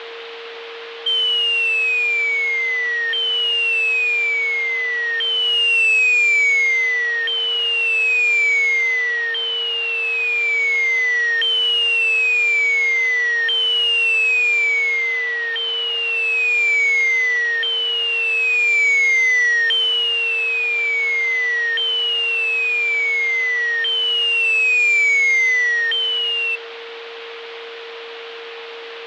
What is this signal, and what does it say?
A tone that sweeps in pitch again and again, with radio static, fading and a steady whistle near 460 Hz. There is no code.